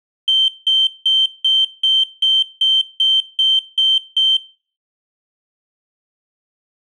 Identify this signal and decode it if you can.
Beep code, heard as a piezo beeper, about 3100 Hz. 11 short. In AMI BIOS tables: cache memory error.